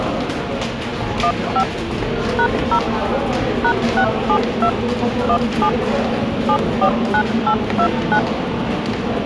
DTMF, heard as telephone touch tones, dialled by machine, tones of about 80 ms, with the noise of a subway station. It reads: 15 #0 #672 17 749829